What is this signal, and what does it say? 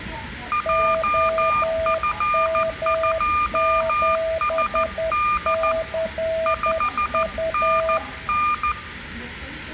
Morse code, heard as two keyed tones, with room echo and the noise inside a subway train. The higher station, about 14 wpm, 1200 Hz: JF2SD 5NN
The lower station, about 10 wpm, 650 Hz: OM7CU